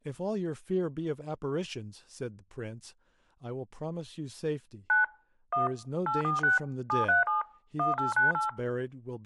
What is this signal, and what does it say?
DTMF, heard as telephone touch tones, dialled by machine, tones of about 140 ms, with speech in English. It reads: 9 1 846 737 1898